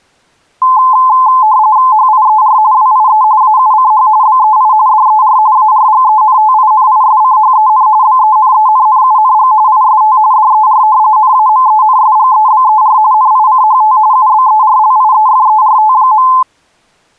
RTTY (45.45 baud, 170 Hz shift), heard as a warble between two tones, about 950 Hz centre. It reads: HIER WIE AUCH BEI DER ARGENTINISCHEN BENENNUNG IST DER NAMENSGEBER NICHT UBERLIEFERT.